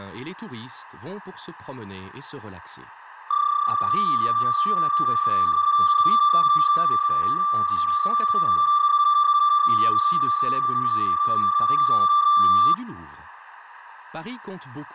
PSK31 (31.25 baud), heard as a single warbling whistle, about 1180 Hz, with radio static.